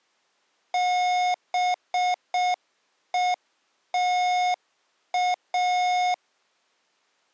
Morse code, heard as electronic beeps, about 6 wpm, 720 Hz. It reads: BETA